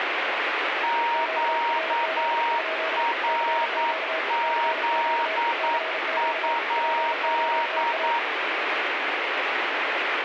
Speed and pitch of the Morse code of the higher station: 9 wpm, 940 Hz

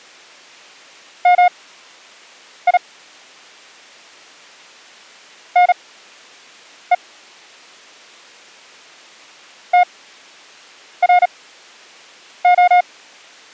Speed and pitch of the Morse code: 37 wpm, spaced as for 7 wpm, 720 Hz

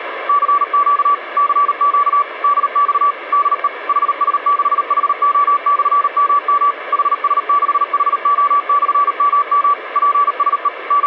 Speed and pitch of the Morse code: 38 wpm, 1150 Hz

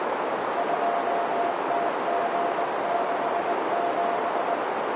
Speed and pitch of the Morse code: 19 wpm, 690 Hz

